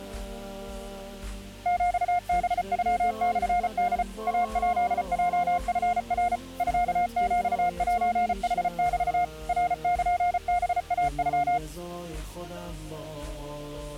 Morse code (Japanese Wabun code), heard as a keyed tone, machine-sent, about 34 wpm, 710 Hz. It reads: ヒハノモホ イヱヲチナ ミヒセヌメ ナルハイノ